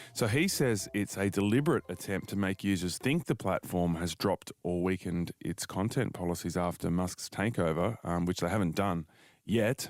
Speech in English. There is no code.